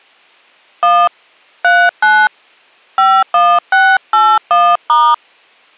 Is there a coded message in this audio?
Yes: DTMF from 0.8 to 5.1 s, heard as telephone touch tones, dialled by hand, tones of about 250 ms. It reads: 1 39 51681*